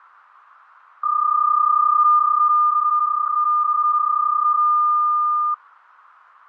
PSK31 (31.25 baud), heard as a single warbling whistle, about 1210 Hz.